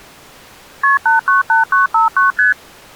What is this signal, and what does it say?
Multi-frequency trunk signalling (R1, as on North American trunks), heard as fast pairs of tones, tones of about 140 ms. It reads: KP 898959 ST